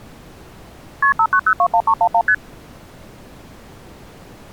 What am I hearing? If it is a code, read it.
Multi-frequency trunk signalling (R1, as on North American trunks), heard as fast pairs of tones, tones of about 70 ms. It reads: KP 59021311 ST